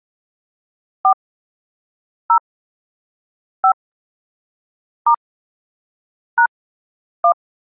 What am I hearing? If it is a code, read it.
DTMF, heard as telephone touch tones, dialled by hand, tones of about 80 ms. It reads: 4 0 5 * # 1